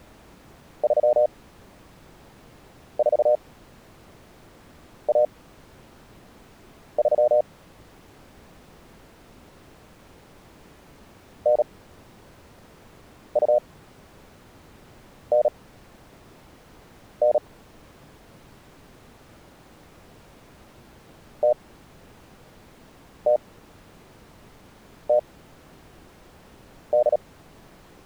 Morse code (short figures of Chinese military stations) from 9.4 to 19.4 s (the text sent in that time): 9299